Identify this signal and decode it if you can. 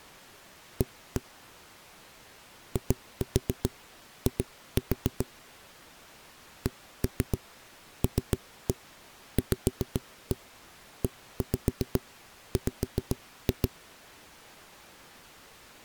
Tap code, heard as knocks on a wall, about 7 knocks a second. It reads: A II CLVEW